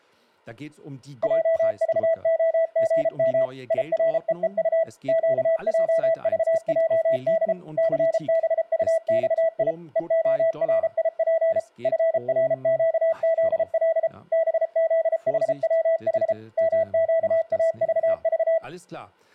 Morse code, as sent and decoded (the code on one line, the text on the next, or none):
.--- ...- --- --. -- / .. .-. . . ..- / --.- .--- ...- .--- -.. / -.-. -... ..- -..- .. / . --- .-. .. .--. / ..-. .-. --.- --.. .-.. / -... --.. .... .-- .... / -- --.- .- ...- ...-
JVOGM IREEU QJVJD CBUXI EORIP FRQZL BZHWH MQAVV